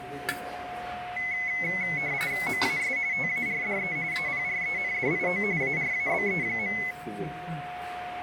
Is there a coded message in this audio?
Yes: RTTY (45.45 baud, 170 Hz shift) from 1.2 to 6.9 s, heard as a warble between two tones, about 2100 Hz centre, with radio static, a steady whistle near 720 Hz and the noise of a crowd indoors. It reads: MAS TARDE APRENDIO ARABE.